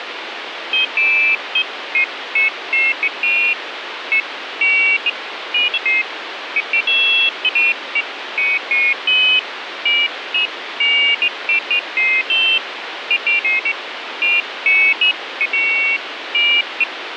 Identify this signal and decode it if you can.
Pairs of high tones at irregular times, with radio static. There is no code.